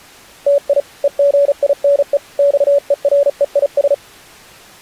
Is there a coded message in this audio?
Yes: Morse code (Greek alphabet) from 0.4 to 4.0 s, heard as a keyed tone, hand-sent with a paddle, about 36 wpm, 570 Hz. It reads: ΤΙ ΕΓΙΝΕ ΞΕΡΕΙΣ